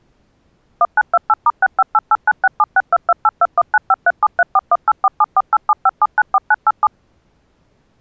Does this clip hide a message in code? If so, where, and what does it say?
Yes: DTMF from 0.8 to 6.9 s, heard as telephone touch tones, dialled by machine, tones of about 40 ms. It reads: 1928*658896762282195373418474875794987